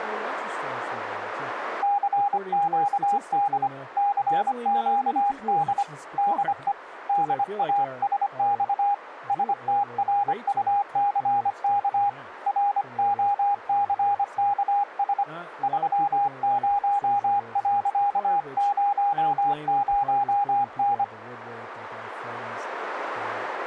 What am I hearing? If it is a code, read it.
Morse code, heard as a keyed tone, hand-sent with a paddle, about 25 wpm, 810 Hz, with radio static and speech in English. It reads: CQD CQD DE DASX STRUCK ROCKS 30.00N